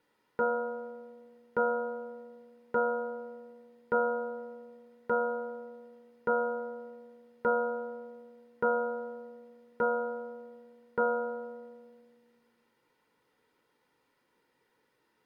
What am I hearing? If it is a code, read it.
Clock strike, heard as a bell. 10. Ten o'clock.